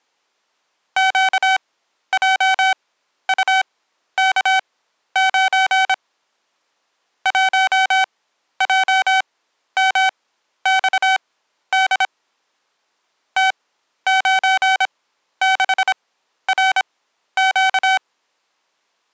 Morse code, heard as electronic beeps, machine-sent, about 26 wpm, spaced as for 12 wpm, 760 Hz. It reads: QJUK9 1JMXD T96RQ